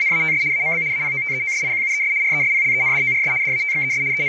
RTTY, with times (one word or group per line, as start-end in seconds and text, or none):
0.0-0.4 …
0.5-0.8 AMB
0.9-2.1 APOTEOSIQUES
2.2-3.3 RESPLENDORS
3.4-4.0 DATXES
4.1-4.3 …